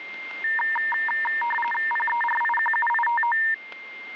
RTTY (45.45 baud, 850 Hz shift), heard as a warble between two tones, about 1370 Hz centre, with radio static, static crashes and a steady whistle near 2110 Hz. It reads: PERIQUITO